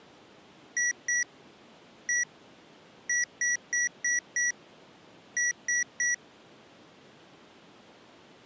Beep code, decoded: 2-1-5-3

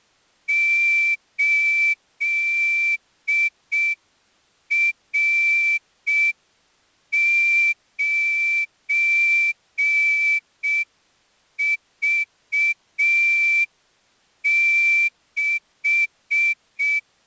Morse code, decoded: 8R9V6

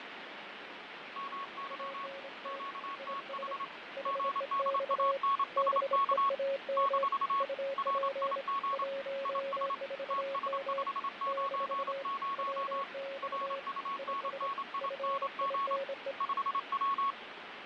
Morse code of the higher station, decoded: MY QTH GDANSK - RIG IS TS590 RUNNING 5W

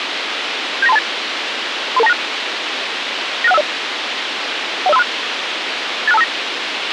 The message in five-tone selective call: 79328 33296 96150 10536 86259

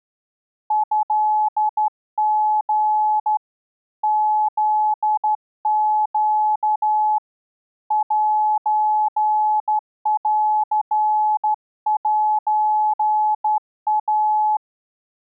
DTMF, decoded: none

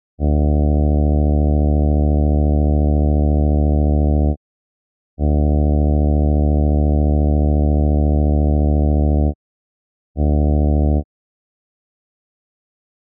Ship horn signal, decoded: 2 long, 1 short

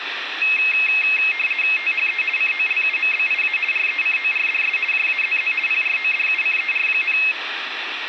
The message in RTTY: THE COLUMBIA RECORDS JAZZ PRODUCER,

